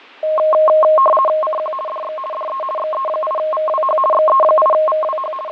RTTY (50 baud, 450 Hz shift), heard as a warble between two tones, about 850 Hz centre, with radio static and fading. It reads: CQ DX DE XE8VWH XE8VWH …